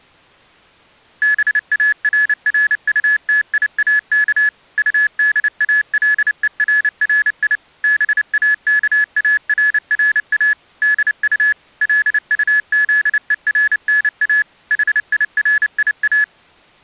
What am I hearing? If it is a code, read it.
Morse code, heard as electronic beeps, machine-sent, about 29 wpm, 1700 Hz. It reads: BARRUTIAK UDALERRI BAKARRA DU LUZERNA HIRIA